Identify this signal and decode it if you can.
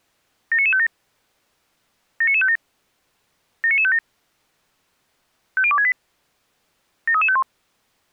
Five-tone selective call (ZVEI), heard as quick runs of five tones, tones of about 70 ms. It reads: 79957 79957 79957 50268 73351